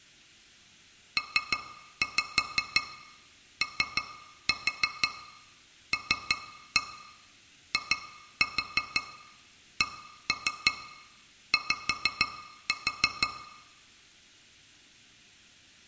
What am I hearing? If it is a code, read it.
Tap code, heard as taps on glass, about 6 knocks a second, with room echo. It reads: POLICY